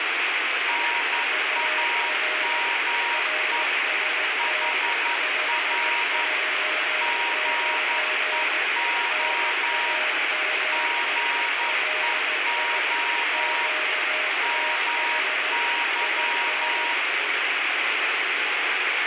Morse code, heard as two keyed tones, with heavy radio static. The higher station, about 11 wpm, 950 Hz: NAME HR GEO GEO MY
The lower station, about 16 wpm, 620 Hz: UR RST 539 NAME LI QTH IS